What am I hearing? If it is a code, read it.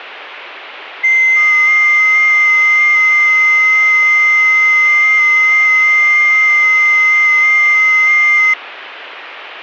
FT8 (several signals at once), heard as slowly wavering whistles, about 6.25 baud.